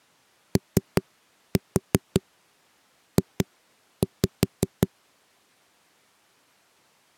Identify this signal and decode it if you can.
Tap code, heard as knocks on a wall, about 5 knocks a second. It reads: OJ